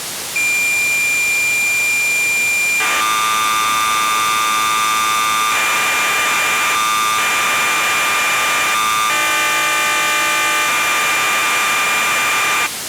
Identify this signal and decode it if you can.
Cassette data (Kansas City type), 1200 baud, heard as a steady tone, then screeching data, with tape hiss.